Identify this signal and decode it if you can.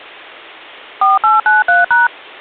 DTMF, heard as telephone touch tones, dialled by machine, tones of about 160 ms. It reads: 4893#